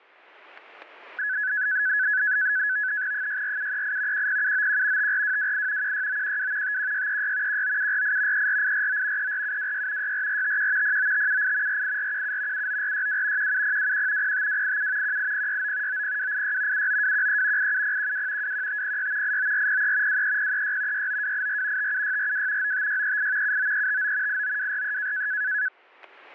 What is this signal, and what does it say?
NAVTEX (SITOR-B), 100 baud, 170 Hz shift, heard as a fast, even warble, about 1600 Hz centre, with static crashes. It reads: 64738 10791 54228 16912 51636 19748 34849 34726 64451 09578 48417 79462 17021 05287 18069 90286 79213 87012 21506 89403 23036 69284 57642 95638 79359 89243